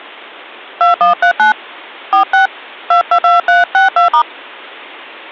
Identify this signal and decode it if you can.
DTMF, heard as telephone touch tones, dialled by hand, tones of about 110 ms. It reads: 2139 46 222362*